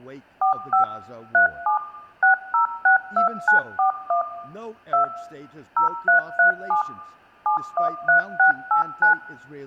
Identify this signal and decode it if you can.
DTMF, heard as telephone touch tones, dialled by machine, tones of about 120 ms, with room echo and speech in English. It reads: 45 37 6062941 2 0337 713689